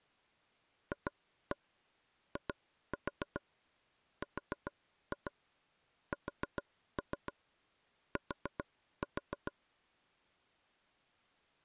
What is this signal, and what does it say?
Tap code, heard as taps on a table, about 7 knocks a second. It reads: FIRST